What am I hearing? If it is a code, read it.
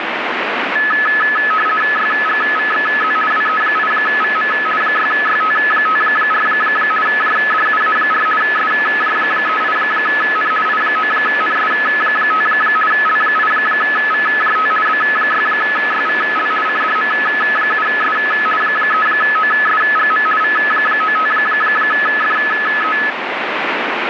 RTTY (50 baud, 450 Hz shift), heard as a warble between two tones, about 1500 Hz centre, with radio static. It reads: YGVXZ WE8VM 6YT54 JDUA4 SJ38N I9NS5 L8VJT B6YVL CDM7S 3OSGM V95FE